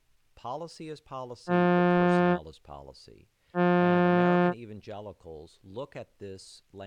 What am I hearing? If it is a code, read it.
Ship horn signal, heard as a ship's horn, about 180 Hz, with speech in English. 2 short. At sea: I am altering course to port.